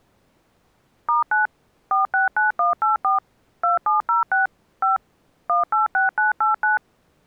DTMF, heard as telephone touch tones, dialled by machine, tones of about 140 ms. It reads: *9 469184 2706 5 186989